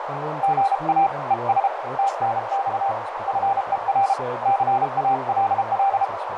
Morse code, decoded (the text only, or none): GA ES TNX FER CALL